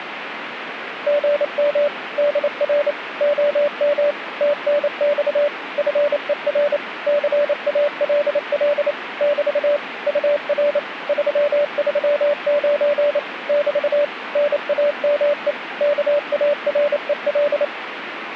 Morse code, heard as a keyed tone, machine-sent, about 28 wpm, 580 Hz, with radio static. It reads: GM DR OM TNX FER CALL <BT> UR 339 <BT> NAME KAREL